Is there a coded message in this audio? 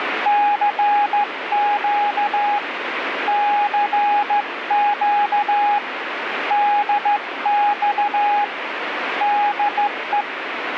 Yes: Morse code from 0.2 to 10.3 s, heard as a keyed tone, hand-sent with a straight key, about 14 wpm, 830 Hz, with radio static. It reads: CQ CQ DX DE